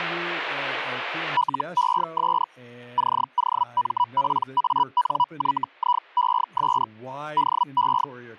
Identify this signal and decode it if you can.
Hellschreiber (Feld-Hell, 122.5 baud), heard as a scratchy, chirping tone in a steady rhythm, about 980 Hz, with speech in English. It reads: LES COMPANYIES DE